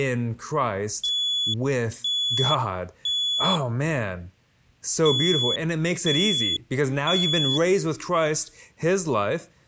Alarm pattern, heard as an alarm's beeps, played twice, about 3400 Hz, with speech in English. Temporal three. Smoke or fire, evacuate.